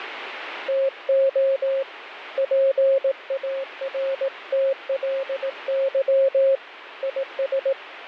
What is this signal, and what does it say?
Morse code, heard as a keyed tone, hand-sent with a paddle, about 18 wpm, 540 Hz, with radio static. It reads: TO PARTLY IS